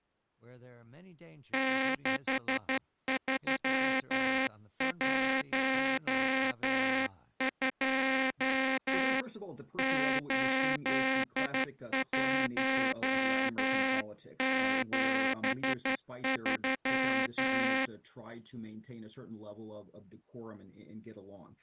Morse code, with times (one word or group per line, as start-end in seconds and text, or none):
1.5-9.2 6312
9.8-17.9 8173